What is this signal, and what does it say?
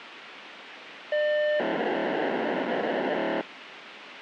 POCSAG pager data (1200 baud), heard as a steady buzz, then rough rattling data, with radio hiss.